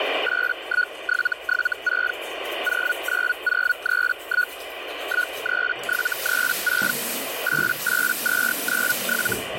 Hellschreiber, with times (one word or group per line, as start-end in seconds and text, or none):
0.2-2.1 81776
2.6-4.5 09031
5.0-6.9 13736
7.4-9.3 88297